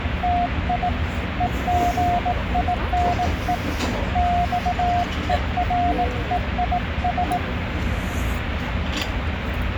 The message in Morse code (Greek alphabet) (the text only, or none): ΤΙ ΕΓΙΝΕ ΞΕΡΕΙΣ